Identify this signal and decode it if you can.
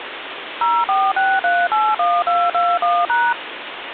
DTMF, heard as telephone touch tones, dialled by machine, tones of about 230 ms, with phone line noise. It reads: 046381221#